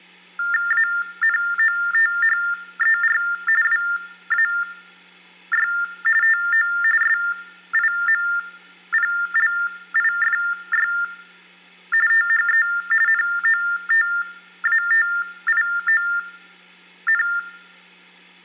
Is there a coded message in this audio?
Yes: TTY/TDD text telephone tones (45.45 baud Baudot) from 0.4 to 17.4 s, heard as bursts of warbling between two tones, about 400 Hz shift, 1600 Hz centre, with hum. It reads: ANOTHER WAY TO SIMPLIFY THE NOTATION